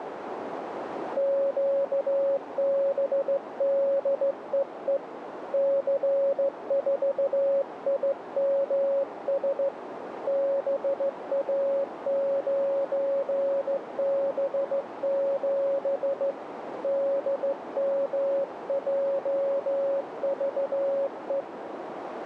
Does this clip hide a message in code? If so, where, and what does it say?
Yes: Morse code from 1.1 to 21.5 s, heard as a keyed tone, hand-sent with a straight key, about 15 wpm, 550 Hz, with radio static and a narrow filter. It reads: QBDEE C4IMS BA9B7 DMJVE